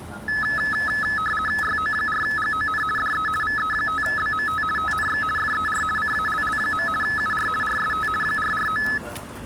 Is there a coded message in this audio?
Yes: RTTY (50 baud, 450 Hz shift) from 0.3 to 9.0 s, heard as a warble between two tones, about 1500 Hz centre, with street noise. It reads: YO4GON DE VE5BMT TNX FER CALL. UR RST 449